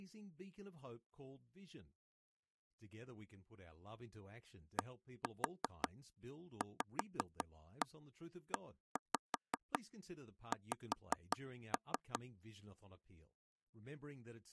Tap code, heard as taps on a table, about 5 knocks a second, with speech in English. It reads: DVEX